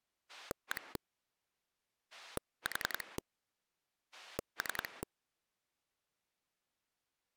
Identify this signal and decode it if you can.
Pulse dialling, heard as a rotary dial, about 10 pulses a second. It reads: 1 4 3